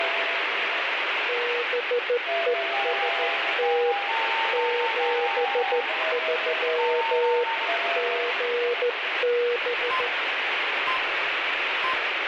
Morse code, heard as a keyed tone, hand-sent with a straight key, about 14 wpm, 480 Hz, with heavy radio static. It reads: BEST 73 GB